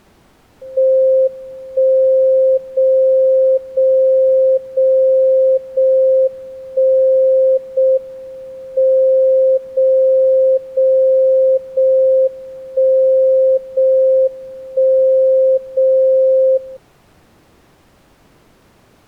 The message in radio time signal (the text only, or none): 1 0 0 0 0 1 0 M 0 0 0 1 0 1 0 0